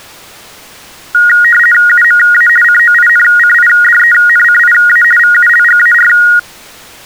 RTTY (50 baud, 450 Hz shift), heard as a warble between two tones, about 1650 Hz centre. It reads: UMA COINCIDENCIA VULGAR